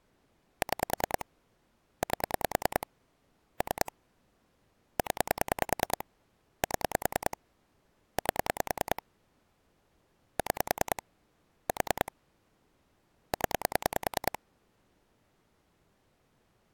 Pulse dialling, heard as clicks on a phone line, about 10 pulses a second. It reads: 6 8 3 0 7 8 6 4 0